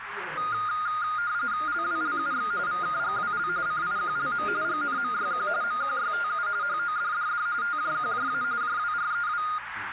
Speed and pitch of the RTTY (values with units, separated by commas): 45.45 baud, 170 Hz shift, 1320 Hz centre